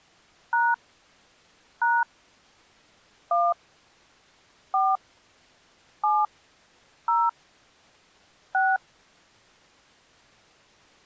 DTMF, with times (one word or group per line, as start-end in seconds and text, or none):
0.5-0.7 #
1.8-2.0 #
3.3-3.5 1
4.7-5.0 4
6.0-6.3 7
7.1-7.3 0
8.5-8.8 6